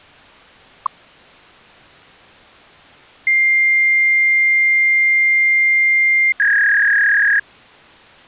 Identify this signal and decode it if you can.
Fax machine handshake, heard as a long tone and a warble.